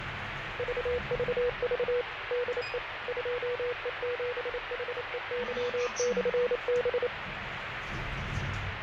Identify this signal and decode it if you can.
Morse code, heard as a keyed tone, machine-sent, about 28 wpm, 490 Hz, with radio static, fading and the noise inside a lift. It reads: VVV DE 2E7HEY/B